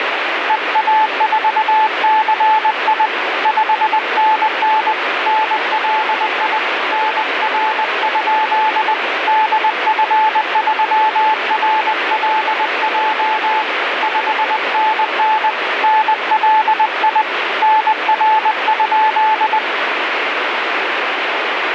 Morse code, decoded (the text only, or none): EA4CI 5NN NLI NR? DF3RLJ 5NN NLI NR?